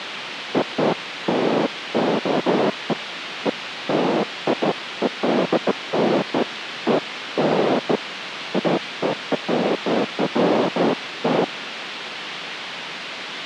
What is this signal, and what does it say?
Bursts of noise, with radio hiss and a squelch burst at the end. There is no code.